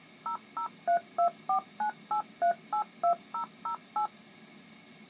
DTMF, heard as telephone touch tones, dialled by machine, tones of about 100 ms. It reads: 0032498382008